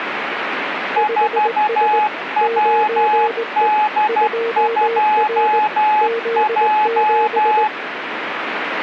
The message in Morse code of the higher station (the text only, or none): 4WD2J